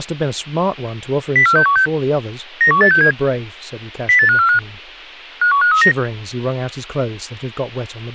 Five-tone selective call (CCIR), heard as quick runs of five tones, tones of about 100 ms, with speech in English. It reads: 04616 91867 08545 51539